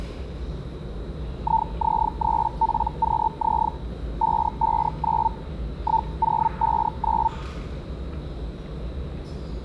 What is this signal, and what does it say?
Hellschreiber (Feld-Hell, 122.5 baud), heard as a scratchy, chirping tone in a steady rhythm, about 900 Hz, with the noise of a subway station. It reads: IZ3PQZ 559 1059